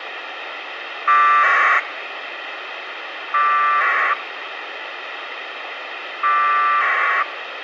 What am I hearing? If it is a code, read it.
Packet radio (AX.25, as in APRS), 1200 baud, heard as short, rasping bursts, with radio hiss.